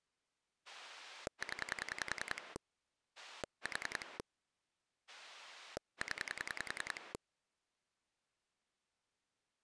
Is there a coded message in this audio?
Yes: pulse dialling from 0.7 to 7.2 s, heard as a rotary dial, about 10 pulses a second. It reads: 0 4 0